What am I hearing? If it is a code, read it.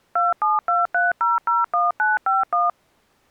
DTMF, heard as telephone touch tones, dialled by machine, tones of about 170 ms. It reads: 2723001951